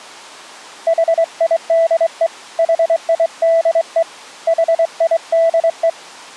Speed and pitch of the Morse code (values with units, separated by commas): 24 wpm, 660 Hz